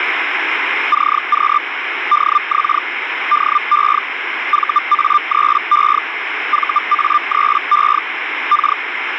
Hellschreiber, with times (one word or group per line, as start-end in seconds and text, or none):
0.9-1.6 CQ
2.1-2.8 DX
3.3-4.0 DE
4.5-6.0 VA3E
6.5-8.0 VA3E
8.5-8.8 K